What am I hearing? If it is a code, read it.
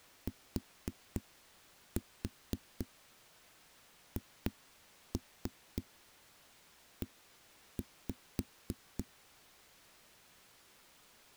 Tap code, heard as knocks on a wall, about 3 knocks a second. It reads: THE